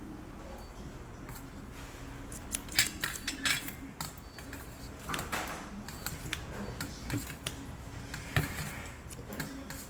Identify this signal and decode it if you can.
The noise of a restaurant. There is no code.